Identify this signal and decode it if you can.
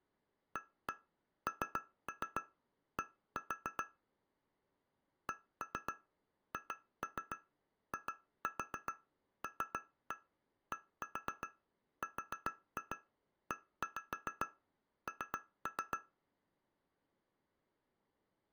Tap code, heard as taps on glass, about 7 knocks a second. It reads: AND CHILDREN